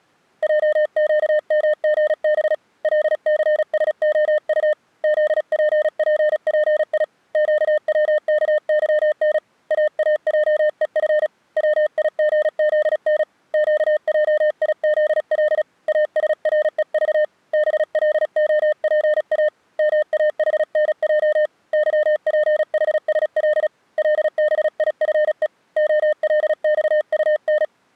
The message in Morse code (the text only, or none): JQMGB LCSOU ZPPPI QWKYN AAJEF WIGZN QJIZL ASREV BLOPA MAHNJ YPHSL LBIFE OLXUN